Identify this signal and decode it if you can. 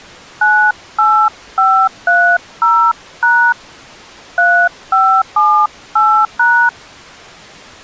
DTMF, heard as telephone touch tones, dialled by hand, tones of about 300 ms. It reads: 98530# 3578#